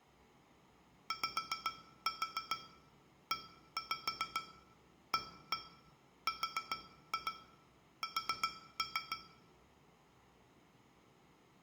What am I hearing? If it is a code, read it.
Tap code, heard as taps on glass, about 7 knocks a second, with room echo. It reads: YEARS